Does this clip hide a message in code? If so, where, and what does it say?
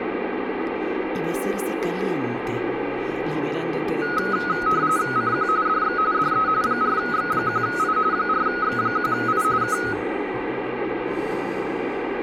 Yes: RTTY (45.45 baud, 170 Hz shift) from 4.0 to 9.9 s, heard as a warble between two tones, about 1360 Hz centre, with radio static. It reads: CQ DX DE 4X1I 4X1I K